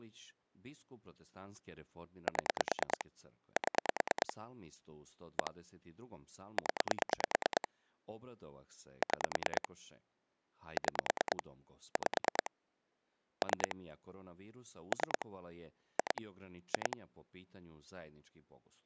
Pulse dialling, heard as clicks on a phone line, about 9 pulses a second, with speech in Croatian. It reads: 7 7 1 0 6 6 5 3 3 2 2